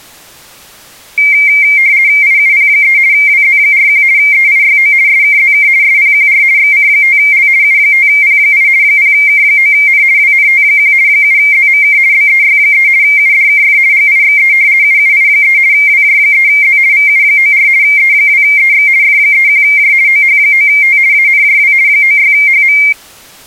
RTTY (50 baud, 170 Hz shift), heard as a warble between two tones, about 2200 Hz centre. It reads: IUP3 WZ41 EIYO SKZK SPQR XC5L U5P8 0K9N WNT1 7ZMK BEY3 UDKF GIXE UUI3 WJ3Z VU94 E2EX F31J OH9T ANJW 96HM